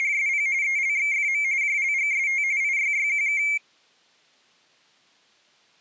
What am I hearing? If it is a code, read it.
RTTY (45.45 baud, 170 Hz shift), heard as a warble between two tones, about 2200 Hz centre. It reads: … ELXFM JLGST IYYQK